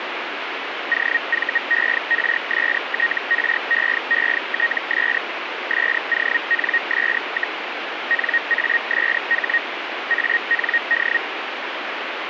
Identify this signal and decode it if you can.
Hellschreiber (Feld-Hell, 122.5 baud), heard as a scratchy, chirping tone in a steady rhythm, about 1850 Hz, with radio static. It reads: OVERSTREETS SONS, NASH AND